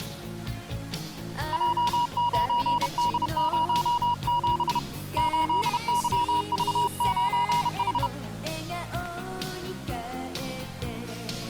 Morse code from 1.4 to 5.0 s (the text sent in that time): J9D07